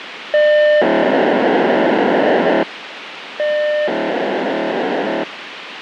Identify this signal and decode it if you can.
POCSAG pager data (1200 baud), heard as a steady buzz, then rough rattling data, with radio hiss.